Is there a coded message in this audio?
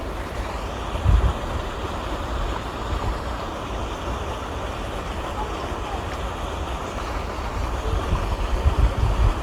No, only the noise of a park.